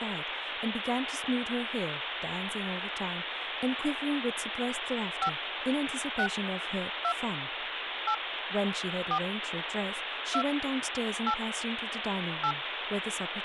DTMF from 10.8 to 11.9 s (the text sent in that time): 8